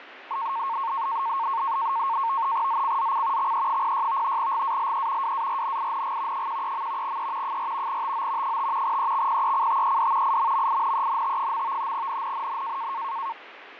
NAVTEX (SITOR-B), 100 baud, 170 Hz shift, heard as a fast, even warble, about 1000 Hz centre, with radio static and fading. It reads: ZCZC XE06 GALE WARNING 13. E 4 TO 5 EXPECTED IMMINENT. NNNN